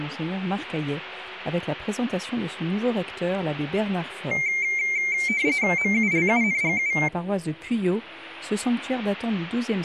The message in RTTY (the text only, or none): MULUNGU